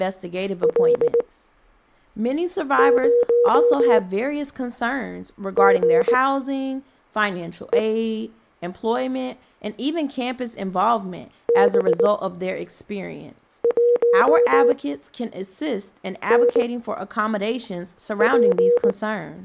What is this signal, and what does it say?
Morse code, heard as a keyed tone, machine-sent, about 19 wpm, spaced as for 5 wpm, 480 Hz, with speech in English. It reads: L0GE B1NP